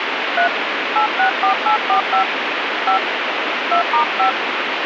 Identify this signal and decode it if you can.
DTMF, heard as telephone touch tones, dialled by hand, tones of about 110 ms, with radio hiss. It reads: 3 864845 5 2*5